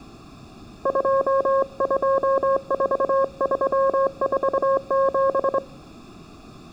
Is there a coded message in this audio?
Yes: Morse code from 0.8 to 5.6 s, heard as a keyed tone, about 24 wpm, 540 Hz, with room echo. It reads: 224347